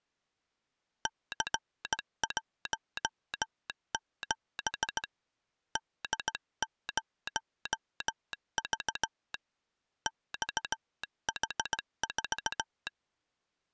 Morse code, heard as a telegraph sounder, hand-sent with a straight key, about 17 wpm. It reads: C17 D0V XH4